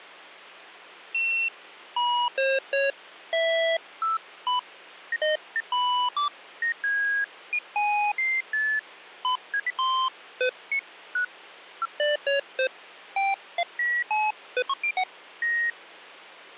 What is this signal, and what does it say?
Electronic bleeps of random pitch and length. There is no code.